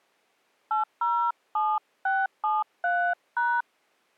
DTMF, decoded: 807673#

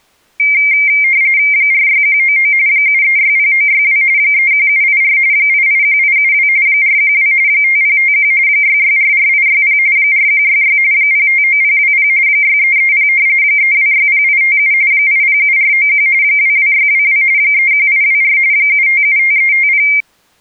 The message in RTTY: 46199 7360962 31784 881872 412 5051 6644860 4166 059020 6330 3260857 807491 22622 31824 7575350

